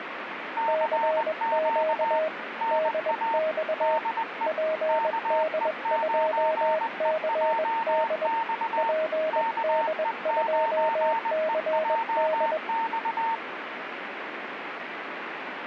Morse code, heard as two keyed tones, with radio static. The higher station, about 20 wpm, 910 Hz: CQ NA DE KE9EJX KE9EJX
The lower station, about 21 wpm, 630 Hz: CQ DX PD2CD PD2CD